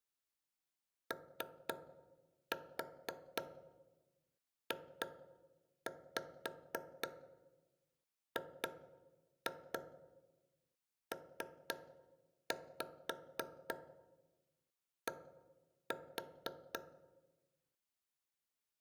Tap code, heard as taps on a table, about 3 knocks a second, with room echo. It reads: OJGPD